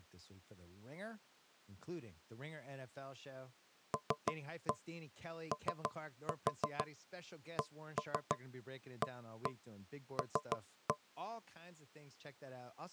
Tap code, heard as knocks on wood, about 6 knocks a second, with speech in English. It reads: LOCAL